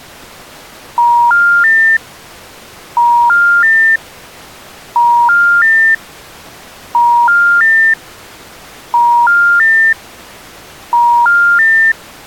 Telephone call progress tone (ITU plan), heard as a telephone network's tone, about 950, 1400, 1800 Hz. Special information tone.